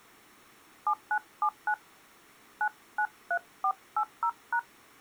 DTMF, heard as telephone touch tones, dialled by hand, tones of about 70 ms. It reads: 7979 993480#